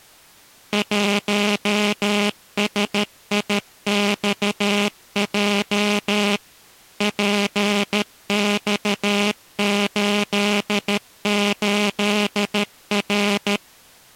Morse code, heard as a buzzer, machine-sent, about 13 wpm. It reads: 1SIXJ PX88R